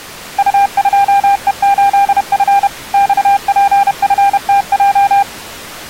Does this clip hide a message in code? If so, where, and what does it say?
Yes: Morse code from 0.3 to 5.3 s, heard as a keyed tone, machine-sent, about 31 wpm, 800 Hz. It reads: U2E8F XPFTJ